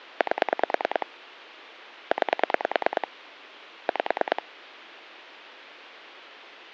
Pulse dialling, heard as clicks on a phone line, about 9 pulses a second, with phone line noise. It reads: 8 9 5